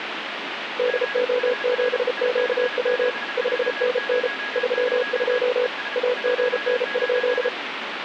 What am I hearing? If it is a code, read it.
Morse code, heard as a keyed tone, hand-sent with a paddle, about 33 wpm, 500 Hz, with radio static and a weaker station near 1660 Hz. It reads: DO7QW 5NN 32 AGN?